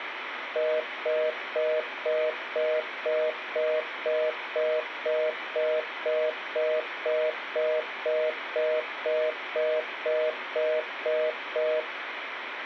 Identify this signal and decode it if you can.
Telephone call progress tone (North American plan), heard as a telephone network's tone, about 480, 620 Hz, 0.25 s on and 0.25 s off, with phone line noise. Congestion tone.